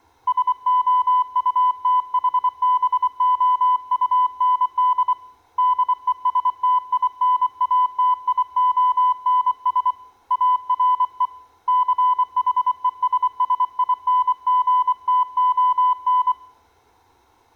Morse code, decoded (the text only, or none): SOUTHBOUND DESTINATIONS ARE CHESSINGTON